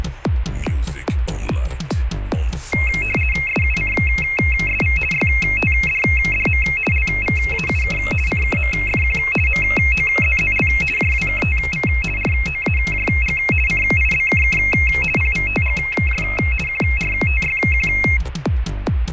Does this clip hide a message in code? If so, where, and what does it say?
Yes: RTTY (50 baud, 450 Hz shift) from 2.7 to 18.2 s, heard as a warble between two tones, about 2350 Hz centre. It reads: SUCSV YTDDM LVAUK CKMFQ MOZZL JWKTV ROAJG CIBKK PVTGJ QRTYQ